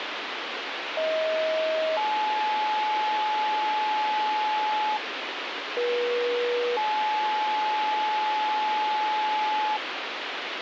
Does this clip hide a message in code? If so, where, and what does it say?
Yes: two-tone page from 1.0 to 9.8 s, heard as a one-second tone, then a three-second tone, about 630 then 860 Hz, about 480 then 860 Hz, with radio hiss.